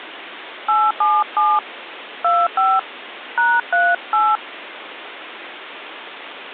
DTMF, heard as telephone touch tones, dialled by hand, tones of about 220 ms, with phone line noise. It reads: 877 25 #38